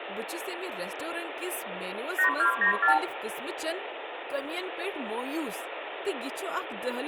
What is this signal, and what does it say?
Multi-frequency trunk signalling (R2, with the far end's replies), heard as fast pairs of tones, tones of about 110 ms, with phone line noise, room echo and speech in Kashmiri. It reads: 8294